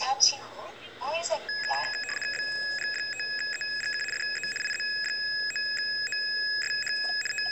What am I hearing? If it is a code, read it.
RTTY (75 baud, 850 Hz shift), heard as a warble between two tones, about 2100 Hz centre, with the noise inside a car. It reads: BG5EGK DE IZ9OSH …